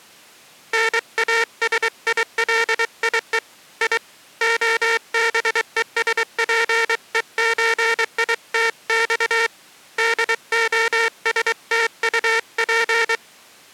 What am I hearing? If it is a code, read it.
Morse code (Russian alphabet), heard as a buzzer, hand-sent with a paddle, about 23 wpm. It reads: НАСИЛИЕ И ОБЕСПЕЧИТЬ ДОСТУП